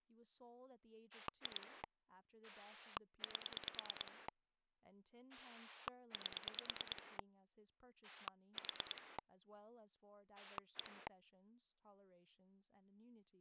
Pulse dialling, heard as a rotary dial, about 9 pulses a second, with speech in English. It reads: 2 8 8 4 1